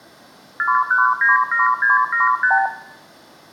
Multi-frequency trunk signalling (R2, with the far end's replies), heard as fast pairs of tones, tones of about 150 ms, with room echo. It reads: 4197675